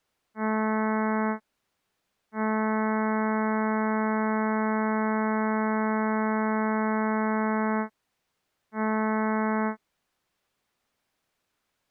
Ship horn signal, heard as a ship's horn, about 220 Hz. 1 short, 1 long, 1 short. At sea: a vessel at anchor warns of its position.